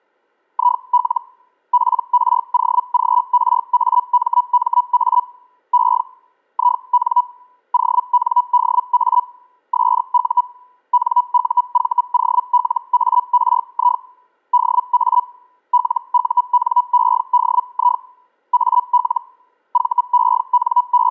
Hellschreiber (Feld-Hell, 122.5 baud), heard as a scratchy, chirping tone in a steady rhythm, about 980 Hz. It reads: IL PROGRAMMA E IN ONDA SU NUVOLARI DA LUNEDI AL …